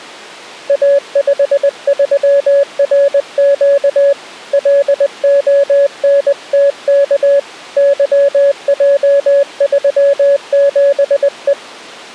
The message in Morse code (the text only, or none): A53RQ LONTK YJ37E